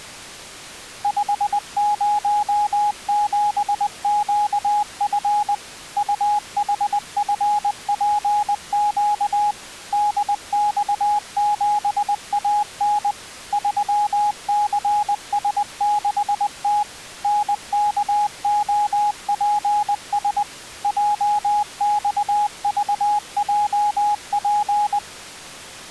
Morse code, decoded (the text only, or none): 507QF UHFPQ DX7AN 3CS6T NKOPS JXVJP